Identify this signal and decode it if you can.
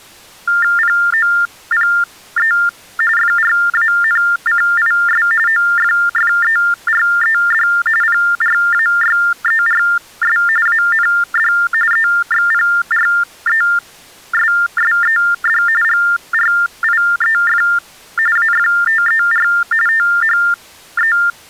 TTY/TDD text telephone tones (45.45 baud Baudot), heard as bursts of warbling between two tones, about 400 Hz shift, 1600 Hz centre. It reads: POPE FRANCIS OFFERED PRAYERS AND EXPRESSED GRIEF AFTER THE